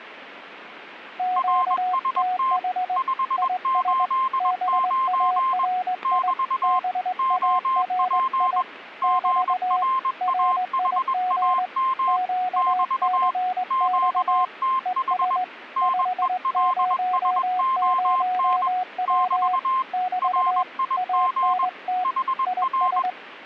Morse code, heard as two keyed tones. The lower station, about 20 wpm, 730 Hz: QTH IS BARI BARI <BT> RIG QCX ES 500W <BT> ANT IS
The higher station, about 21 wpm, 1050 Hz: RST 589 <BT> OP GRAHAM <BT> QTH NELSON <BT> RIG HR